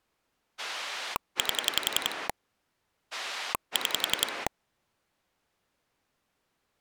Pulse dialling, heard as a rotary dial, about 11 pulses a second. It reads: 8 6